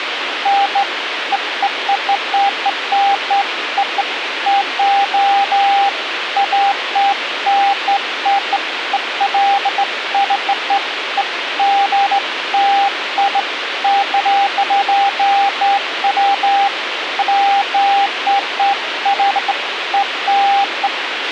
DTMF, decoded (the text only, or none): none